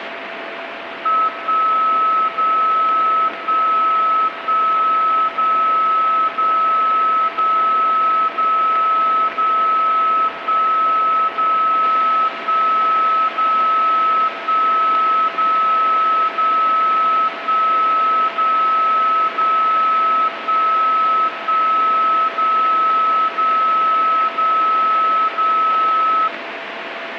Radio time signal (DCF77), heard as a tone whose level steps once a second, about 1290 Hz, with radio static and a steady whistle near 670 Hz. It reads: 1 0 1 1 0 0 0 0 0 1 0 1 0 1 0 0 1 0 0 1 1 0 0 0 0